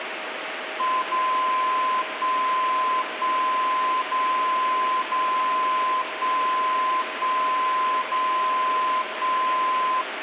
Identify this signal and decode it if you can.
Radio time signal (DCF77), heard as a tone whose level steps once a second, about 1030 Hz, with radio static. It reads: 0 1 1 0 0 1 1 0 1